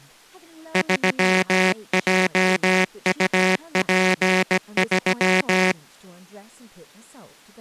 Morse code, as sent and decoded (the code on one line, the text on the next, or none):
...-- .--- ..- .--. ...--
3JUP3